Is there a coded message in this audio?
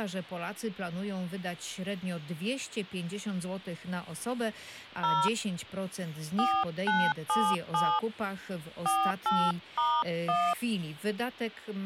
Yes: DTMF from 5.0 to 10.5 s, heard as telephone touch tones, dialled by hand, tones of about 250 ms. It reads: 0 4977 48*1